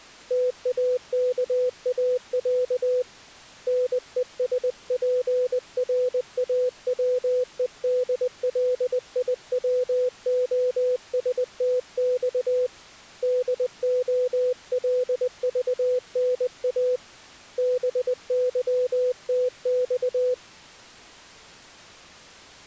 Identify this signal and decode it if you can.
Morse code (Russian alphabet), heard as a keyed tone, hand-sent with a paddle, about 20 wpm, 500 Hz. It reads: ТАКАЯ НЕСПРАВЕДЛИВОСТЬ ДОЛЖНА БЫТЬ